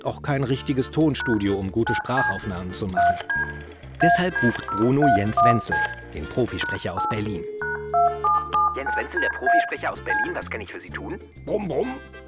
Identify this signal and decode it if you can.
DTMF, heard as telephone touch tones, dialled by hand, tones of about 140 ms, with room echo. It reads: # 9C 3D AD031C #8 #2779DA C